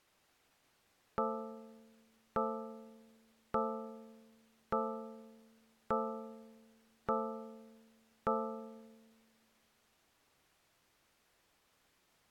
Clock strike, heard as a bell. 7. Seven o'clock.